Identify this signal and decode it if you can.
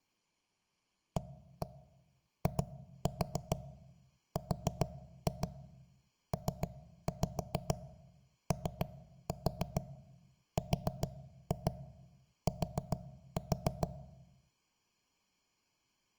Tap code, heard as knocks on wood, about 6 knocks a second, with room echo. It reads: AIRPORT